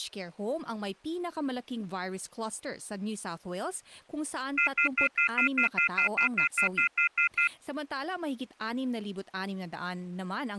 Telephone call progress tone (North American plan), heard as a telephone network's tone, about 1400, 2050, 2450, 2600 Hz, 0.1 s on and 0.1 s off. Off-hook warning tone.